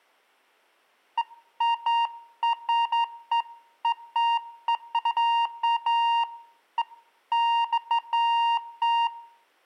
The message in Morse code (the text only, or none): none